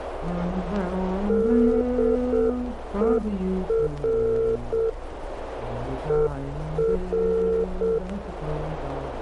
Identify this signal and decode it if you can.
Morse code, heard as a keyed tone, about 7 wpm, 450 Hz, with radio static and a narrow filter. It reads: DER ER